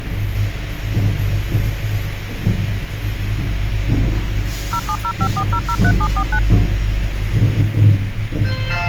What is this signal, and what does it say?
DTMF, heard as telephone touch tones, dialled by machine, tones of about 70 ms, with radio hiss and the noise inside a lift. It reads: 07054003749